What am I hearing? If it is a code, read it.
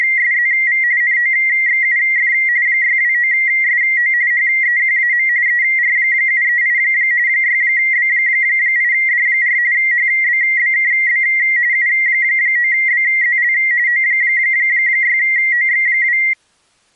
RTTY (45.45 baud, 170 Hz shift), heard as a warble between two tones, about 2000 Hz centre. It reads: … NOXUF 629SO HEQAM ER738 6B8D4 HBBKB U9BZL O6OX2